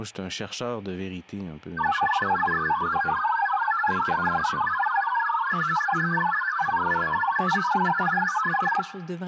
Multi-tone FSK (Olivia or MFSK type), about 1000 Hz wide, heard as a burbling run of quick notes, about 62.5 baud, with room echo and speech in French.